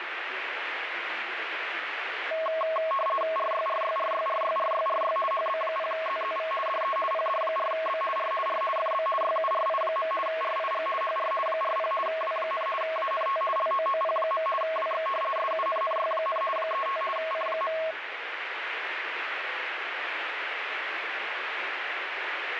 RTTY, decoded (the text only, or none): RYRYRYRYRYRY HB0ZZV DE PD4B R R FB YURI. RIG HR 40 W, ANT LOOP. WX SUNNY, 35 C.